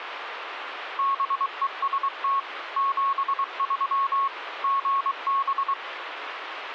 Morse code, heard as a keyed tone, machine-sent, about 23 wpm, 1100 Hz, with radio static. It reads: BEST 73 GB